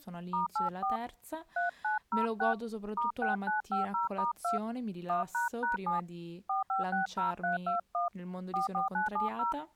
DTMF, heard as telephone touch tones, dialled by hand, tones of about 140 ms, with speech in Italian. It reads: *84 3906 *6950*2 1##7 4560321 44970